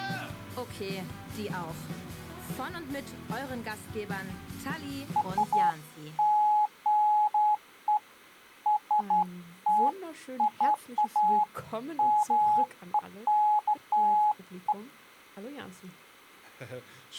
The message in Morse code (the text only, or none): none